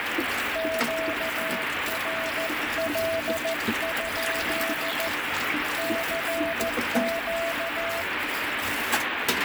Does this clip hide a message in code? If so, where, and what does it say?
Yes: Morse code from 0.5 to 8.1 s, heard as a keyed tone, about 14 wpm, 660 Hz, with heavy radio static and kitchen noise. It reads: QRL? CQ